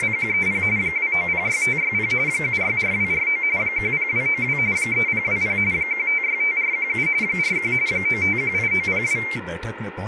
RTTY (45.45 baud, 170 Hz shift), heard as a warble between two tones, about 2200 Hz centre, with speech in Hindi. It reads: … 2906560 764249 10292 3020 1565417 41 9518902